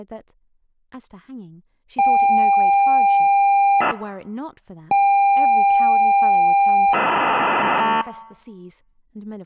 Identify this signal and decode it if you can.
ZX Spectrum tape loading, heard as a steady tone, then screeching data, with speech in English.